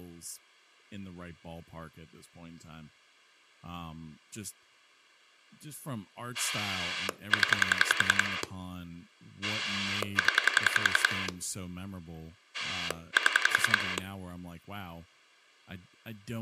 Pulse dialling, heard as a rotary dial, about 10 pulses a second, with speech in English. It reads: 0 0 7